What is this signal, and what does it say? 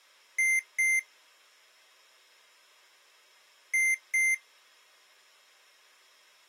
Beep code, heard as beeps from a small speaker, played twice, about 2100 Hz. 2 short. In AMI BIOS tables: memory parity error; in IBM BIOS tables: self-test error shown on screen; in Dell tables: no memory detected.